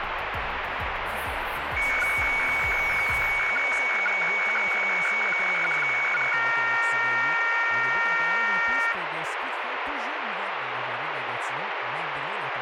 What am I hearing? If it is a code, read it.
Weather fax (radiofax), 120 lines a minute, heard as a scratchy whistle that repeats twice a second, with radio static.